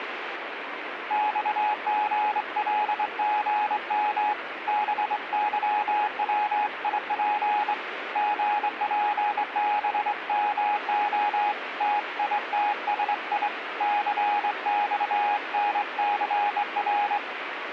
Morse code (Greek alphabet), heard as a keyed tone, hand-sent with a straight key, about 23 wpm, 840 Hz, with radio static. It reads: ΞΓΛΓΜ ΒΥΩΙΠ ΓΠΒΜΟ ΤΙΤΣΙ ΘΞΝΘΡ